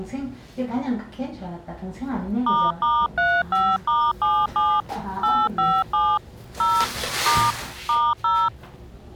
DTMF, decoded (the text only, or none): **35*77 857 0 * *0